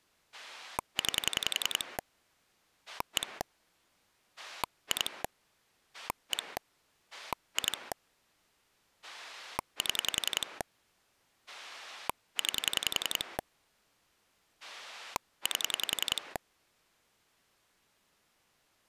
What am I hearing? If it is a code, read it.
Pulse dialling, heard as a rotary dial, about 10 pulses a second. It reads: 9 1 2 1 2 7 9 8